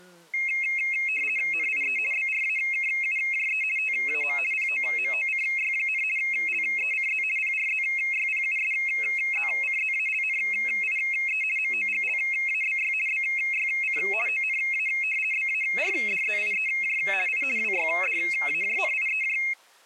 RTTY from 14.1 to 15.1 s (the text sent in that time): ONA